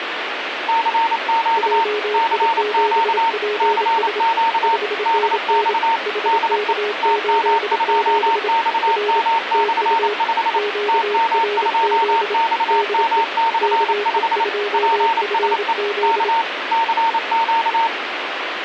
Morse code, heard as two keyed tones, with radio static. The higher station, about 28 wpm, 910 Hz: CQ CQ CQ DX DE TM2XM/5 TM2XM/5 PSE K CQ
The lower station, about 27 wpm, 420 Hz: JI7PS 5NN HK87 R TU QRZ DE KE2FZ